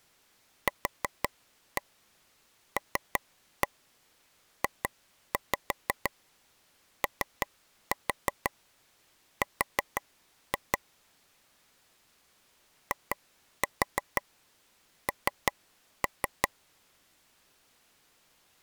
Tap code, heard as taps on a table, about 5 knocks a second. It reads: QLJOR IN